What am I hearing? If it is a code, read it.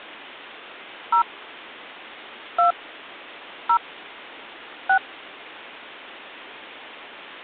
DTMF, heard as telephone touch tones, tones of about 100 ms. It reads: 0 2 0 6